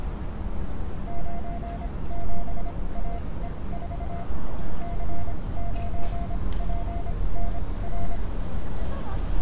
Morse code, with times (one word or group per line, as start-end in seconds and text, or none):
1.1-4.2 97AE4
4.8-8.2 C9PNR